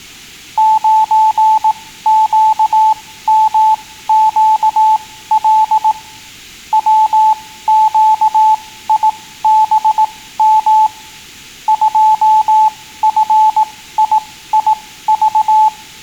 Morse code, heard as a keyed tone, machine-sent, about 18 wpm, spaced as for 14 wpm, 870 Hz. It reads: 9QMQL WQIBM 2FIIV